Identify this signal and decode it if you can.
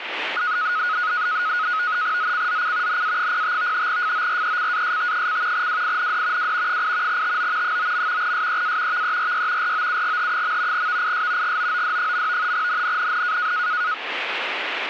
NAVTEX (SITOR-B), 100 baud, 170 Hz shift, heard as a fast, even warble, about 1360 Hz centre, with radio static. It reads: ZCZC NA05 FORECAST: WIND W 8 TO 9. SEA VERY ROUGH. VIS GOOD. NNNN